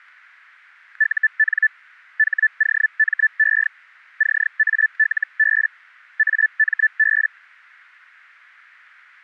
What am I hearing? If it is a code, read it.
Hellschreiber (Feld-Hell, 122.5 baud), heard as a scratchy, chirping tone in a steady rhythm, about 1750 Hz, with static crashes. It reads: UN HOME CALB AMB